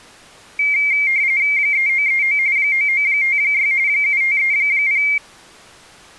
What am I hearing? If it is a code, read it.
RTTY (45.45 baud, 170 Hz shift), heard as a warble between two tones, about 2200 Hz centre. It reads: 3939 9956 7530